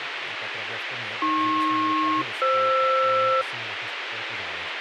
Aircraft SELCAL, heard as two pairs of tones, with radio hiss and speech in Czech. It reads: AP-FR